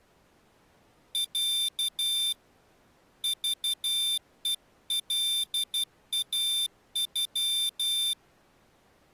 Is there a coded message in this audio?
Yes: Morse code (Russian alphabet) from 1.1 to 8.2 s, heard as a high beeper, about 12 wpm, 3550 Hz. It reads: Я ЖЕЛАЮ